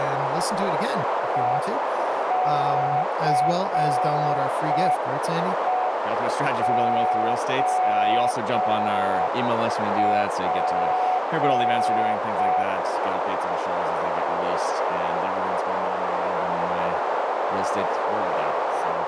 Morse code, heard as a keyed tone, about 5 wpm, 740 Hz, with heavy radio static, a narrow filter and speech in English. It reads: ECEOP